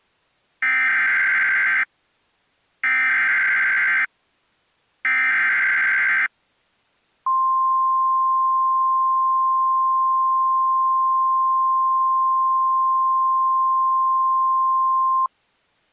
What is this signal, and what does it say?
Emergency Alert System (SAME) tones (header bursts, then the 1050 Hz attention tone), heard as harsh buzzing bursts, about 520.83 baud.